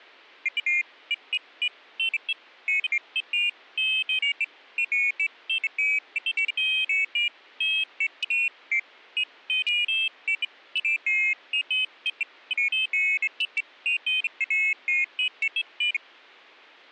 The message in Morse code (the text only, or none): none